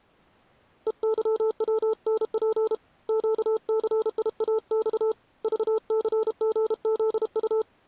Morse code, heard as a keyed tone, hand-sent with a paddle, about 32 wpm, 440 Hz. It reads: EYWNP QCIAX VCGZU